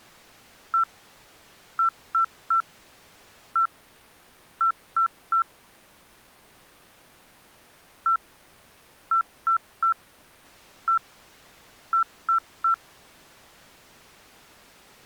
Beep code, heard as beeps, played twice, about 1340 Hz. 1-3-1-3. In Phoenix BIOS tables: keyboard controller test failure.